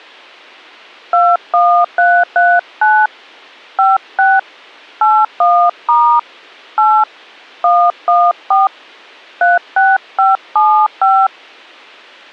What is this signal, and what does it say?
DTMF, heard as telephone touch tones, dialled by hand, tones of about 240 ms. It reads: 21339 56 81* 8 114 36575